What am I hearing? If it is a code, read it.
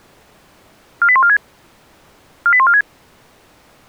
Five-tone selective call (ZVEI), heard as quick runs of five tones, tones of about 70 ms. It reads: 48146 48146